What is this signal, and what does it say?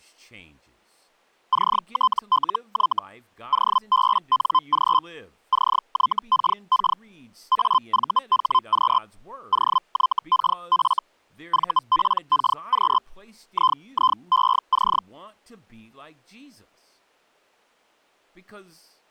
Hellschreiber (Feld-Hell, 122.5 baud), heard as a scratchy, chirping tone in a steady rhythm, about 1030 Hz, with speech in English. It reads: CTLY OBNG CYKK AVHQ OYKF VPKQ IIEC